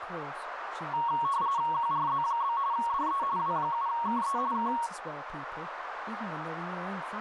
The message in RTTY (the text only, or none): QRZ? DE W7KE K